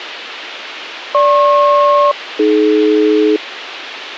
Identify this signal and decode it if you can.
Aircraft SELCAL, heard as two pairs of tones, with radio hiss. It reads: GP-AD